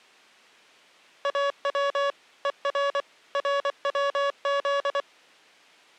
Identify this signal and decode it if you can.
Morse code (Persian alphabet), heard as electronic beeps, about 24 wpm, 560 Hz. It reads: او هر روز